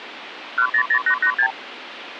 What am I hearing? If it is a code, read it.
Multi-frequency trunk signalling (R2, with the far end's replies), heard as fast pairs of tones, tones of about 80 ms, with phone line noise. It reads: 100886